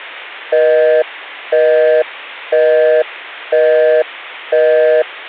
Telephone call progress tone (North American plan), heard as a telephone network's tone, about 480, 620 Hz, 0.5 s on and 0.5 s off. Busy tone.